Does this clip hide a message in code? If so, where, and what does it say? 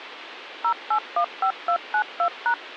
Yes: DTMF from 0.6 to 2.5 s, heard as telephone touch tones, dialled by machine, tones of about 80 ms, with phone line noise. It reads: 0815292#